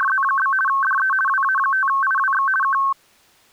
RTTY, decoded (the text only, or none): … DE WA5IWX K